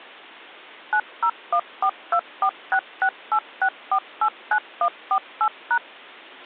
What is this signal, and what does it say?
DTMF, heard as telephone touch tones, dialled by machine, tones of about 70 ms. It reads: 9014246686489148#